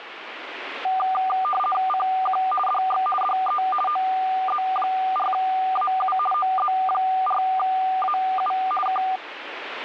RTTY (50 baud, 450 Hz shift), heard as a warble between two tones, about 980 Hz centre, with radio static. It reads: CQ DX DE OZ4AU OZ4AU K